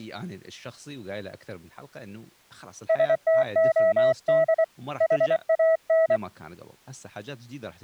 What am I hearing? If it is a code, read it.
Morse code, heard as a keyed tone, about 24 wpm, 650 Hz, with speech in Arabic. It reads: STOD HAN